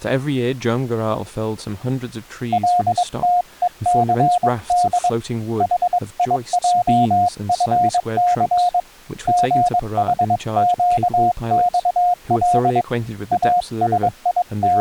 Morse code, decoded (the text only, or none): LTECD HIJFC GHQXL …